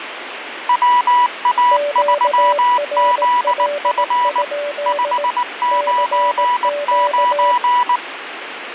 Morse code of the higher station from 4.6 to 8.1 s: 599

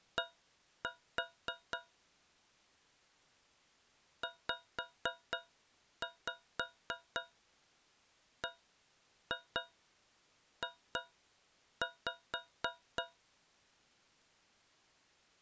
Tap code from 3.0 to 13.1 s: ZBJ

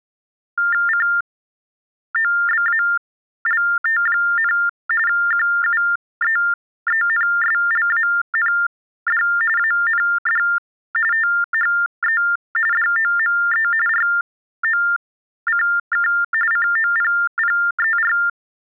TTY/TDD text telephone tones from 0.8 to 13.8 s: COBALT, QUEENSLAND AND THE DOME

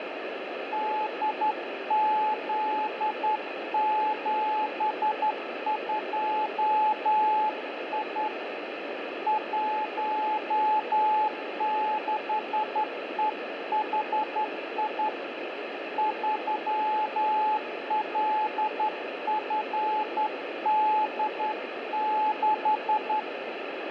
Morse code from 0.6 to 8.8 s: DZ72I

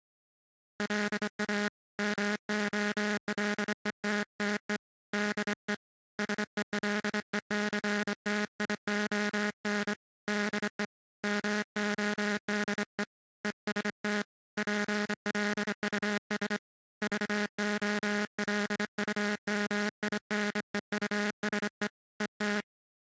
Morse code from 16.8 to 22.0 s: VOLUMINEUSE

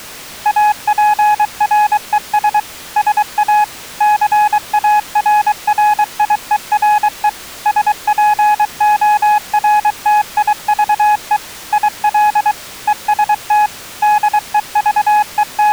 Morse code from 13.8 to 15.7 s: …

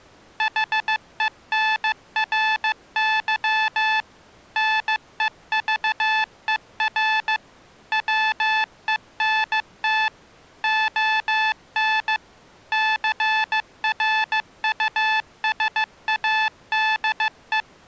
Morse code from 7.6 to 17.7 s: WENT ON CRUSADE

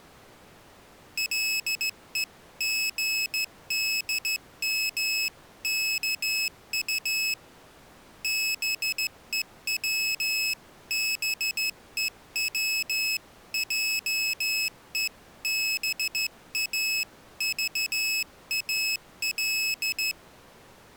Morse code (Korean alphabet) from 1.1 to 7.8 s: 가슴이

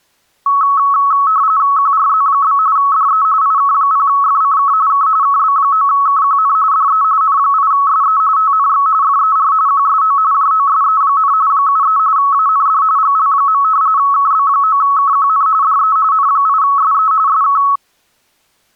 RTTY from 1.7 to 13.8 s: QRZ? DE IK0FCK K KB9KQN DE N8SE TNX FER QSO JOSE, 73 AND GL.

